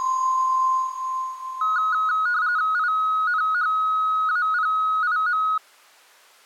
RTTY (45.45 baud, 170 Hz shift), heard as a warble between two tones, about 1360 Hz centre. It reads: INHAPIM